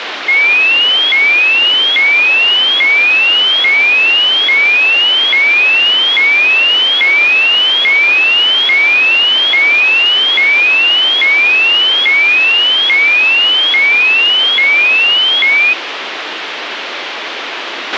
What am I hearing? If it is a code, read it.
A tone that sweeps in pitch again and again, with radio hiss and a squelch burst at the end. There is no code.